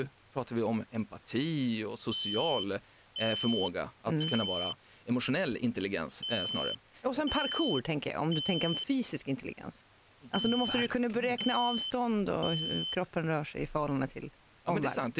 Alarm pattern, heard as an alarm's beeps, played three times, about 3050 Hz, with speech in Swedish. Temporal three. Smoke or fire, evacuate.